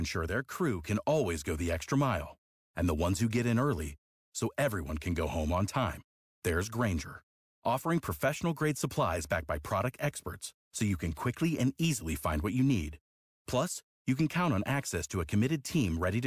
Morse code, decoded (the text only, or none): none